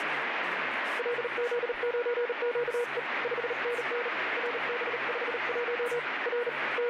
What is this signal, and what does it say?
Morse code, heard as a keyed tone, hand-sent with a bug key, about 38 wpm, 480 Hz, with radio static. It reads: LZ9QE 5NN RB51 R …